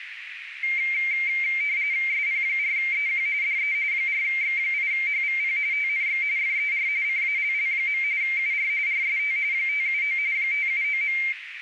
RTTY (45.45 baud, 170 Hz shift), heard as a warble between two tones, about 2200 Hz centre, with radio static and a narrow filter. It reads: SP4EQ DE 4X8HVP TNX FER CALL. UR RST 579 579.